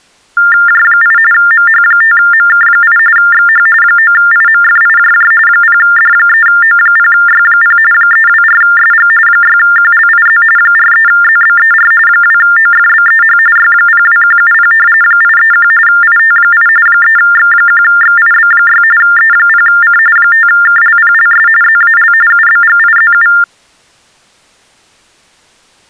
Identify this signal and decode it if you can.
TTY/TDD text telephone tones (45.45 baud Baudot), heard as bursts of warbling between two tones, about 400 Hz shift, 1600 Hz centre. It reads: J8 MH5MK8 XH 9IMFIJJ 0D3O0Y0 324SG 6QLIZ 43ZBER 2OFBEH Y02170 831 IT8 3X1XIB6 E0C 5KLPLS ZAL UBGIZU